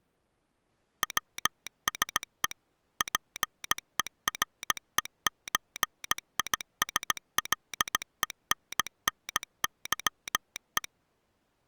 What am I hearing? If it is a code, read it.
Morse code (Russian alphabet), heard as a telegraph sounder, machine-sent, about 17 wpm. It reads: ВСЕ ПЕРЕЧИСЛЕННЫЕ